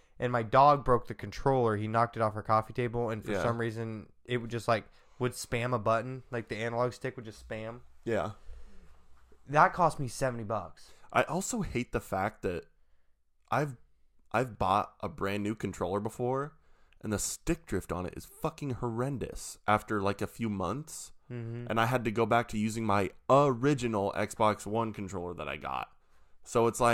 Speech in English. There is no code.